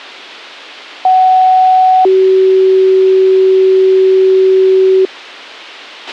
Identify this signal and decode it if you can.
Two-tone page, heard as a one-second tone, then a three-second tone, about 750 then 380 Hz, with a squelch burst at the end.